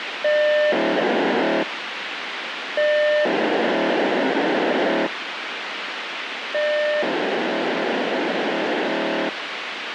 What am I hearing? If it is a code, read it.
POCSAG pager data (1200 baud), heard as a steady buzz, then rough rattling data, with radio hiss.